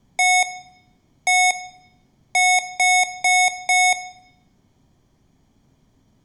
Beep code, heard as beeps from a small speaker, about 730 Hz, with room echo. 1-1-4. In Phoenix BIOS tables: BIOS ROM checksum failure.